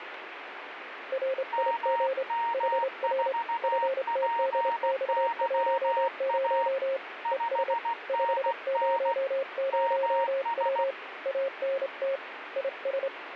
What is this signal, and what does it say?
Morse code, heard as two keyed tones, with radio static. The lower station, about 28 wpm, 540 Hz: RIG HR FTDX10 ES 500W ANT IS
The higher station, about 16 wpm, 930 Hz: MM4PYA 5NN MS